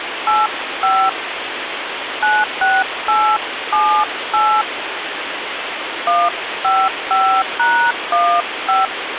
DTMF, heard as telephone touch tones, dialled by hand, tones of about 230 ms, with phone line noise. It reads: 85 96878 155#15